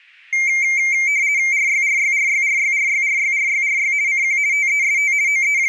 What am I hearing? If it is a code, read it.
RTTY (50 baud, 170 Hz shift), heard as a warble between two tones, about 2200 Hz centre. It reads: RYRYRYRYRYRYRYRY CQ TEST …